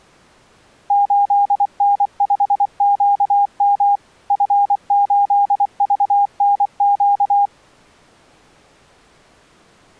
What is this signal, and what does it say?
Morse code, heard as a keyed tone, machine-sent, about 24 wpm, 810 Hz. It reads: 8N5QM F8VNQ